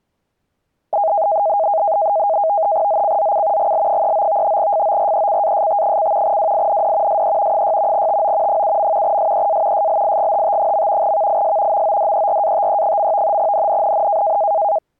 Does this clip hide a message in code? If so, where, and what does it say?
Yes: NAVTEX (SITOR-B), 100 baud, 170 Hz shift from 0.9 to 14.8 s, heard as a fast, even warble, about 730 Hz centre. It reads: ZCZC GL39 FORECAST: WIND SE 6 TO 7. SEA SLIGHT. VIS MODERATE. NNNN